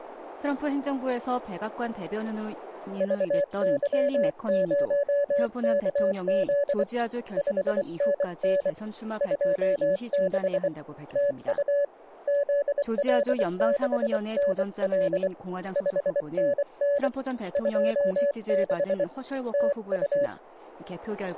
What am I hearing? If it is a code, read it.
Morse code, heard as a keyed tone, hand-sent with a bug key, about 24 wpm, 570 Hz. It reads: VY0KZ 5NN 26 TU ZL6NL 5NN 26 TU